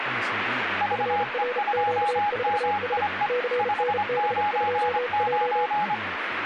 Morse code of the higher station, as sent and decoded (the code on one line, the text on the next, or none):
...- . ..--- -- .. . / ..... ----. ----.
VE2MIE 599